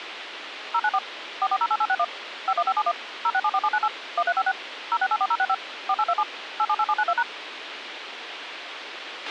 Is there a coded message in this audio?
Yes: DTMF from 0.7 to 7.2 s, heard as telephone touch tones, dialled by machine, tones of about 60 ms, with radio hiss and a squelch burst at the end. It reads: 094 4408861 51571 0674798 1356 0684065 4827 878792#